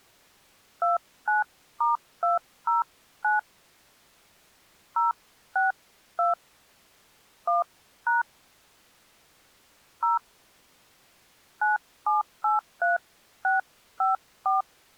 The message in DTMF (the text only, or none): 29*209 062 1# 0 9783654